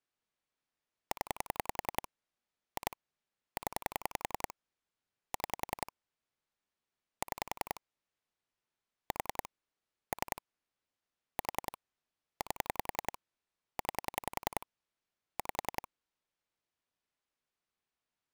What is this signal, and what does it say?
Pulse dialling, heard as clicks on a phone line, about 10 pulses a second. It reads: 0 2 0 6 6 4 3 4 8 9 5